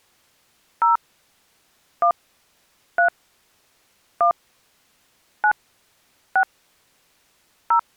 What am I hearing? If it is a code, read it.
DTMF, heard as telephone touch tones, dialled by hand, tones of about 110 ms. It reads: 0 1 3 1 9 6 0